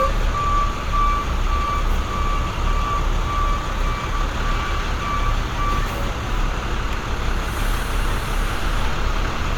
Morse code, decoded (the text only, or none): none